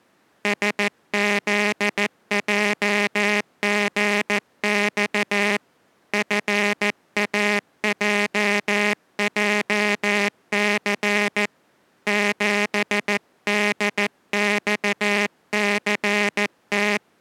Morse code, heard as a buzzer, hand-sent with a paddle, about 14 wpm. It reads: SZJGX FAJJC 7DXCT